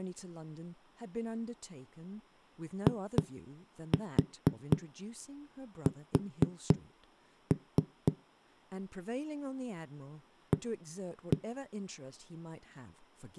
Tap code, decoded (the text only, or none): IS A